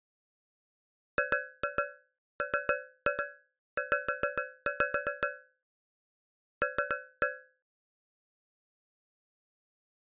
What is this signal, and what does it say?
Tap code, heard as taps on a metal pipe, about 7 knocks a second. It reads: GMZ L